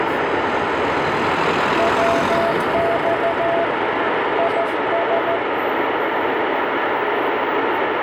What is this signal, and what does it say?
Morse code, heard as a keyed tone, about 14 wpm, 670 Hz, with heavy radio static and street noise. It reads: WX IS